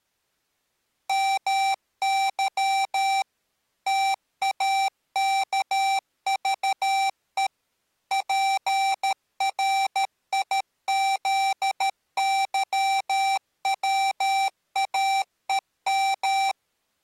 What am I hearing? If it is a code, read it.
Morse code (Russian alphabet), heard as electronic beeps, machine-sent, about 13 wpm, 780 Hz. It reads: МЫ ТАКЖЕ ПРИЗЫВАЕМ